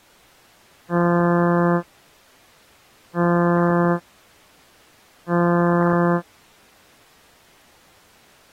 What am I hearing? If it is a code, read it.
Ship horn signal, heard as a ship's horn, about 170 Hz. 3 short. At sea: I am operating astern propulsion.